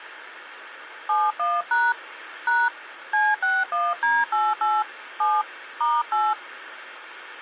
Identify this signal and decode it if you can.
DTMF, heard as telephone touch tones, dialled by hand, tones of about 210 ms, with phone line noise. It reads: 71# # C61D88 7 *8